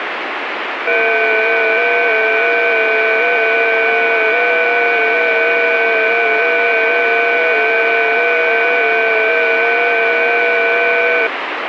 FT8 (several signals at once), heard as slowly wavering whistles, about 6.25 baud, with radio static.